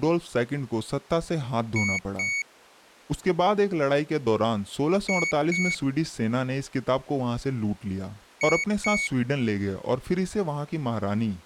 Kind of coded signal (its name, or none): beep code